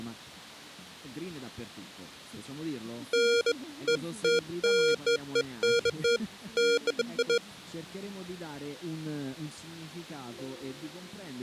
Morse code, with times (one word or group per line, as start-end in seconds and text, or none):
none